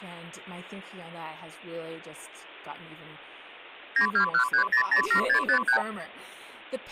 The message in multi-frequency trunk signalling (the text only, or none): 9213007653